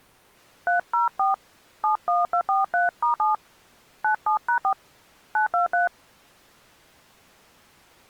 DTMF, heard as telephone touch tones, dialled by hand, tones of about 130 ms. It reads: 304 71243*7 97#4 923